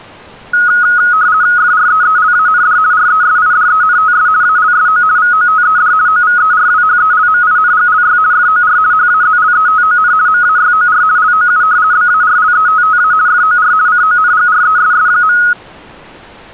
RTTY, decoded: FREELAND RESIDENTS ALSO VOTED OVERWHELMINGLY FOR HAZLETON MAYOR LOU BARLETTA FOR CONGRESS.

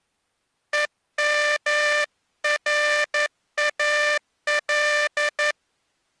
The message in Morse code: EMRAL

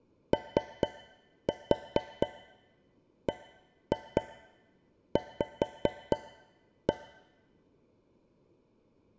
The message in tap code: OBV

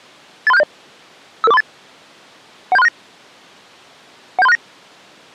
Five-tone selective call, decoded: 83670 55438 17369 17369

